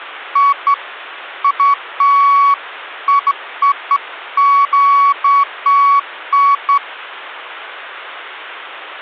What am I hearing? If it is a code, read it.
Beeps of irregular length, with hum. There is no code.